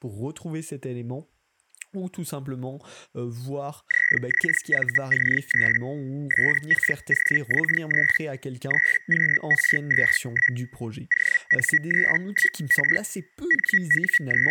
Hellschreiber (Feld-Hell, 122.5 baud), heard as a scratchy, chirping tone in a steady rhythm, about 1950 Hz, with speech in French. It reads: ZXVC3 SKOX3 3QR21 ON31R …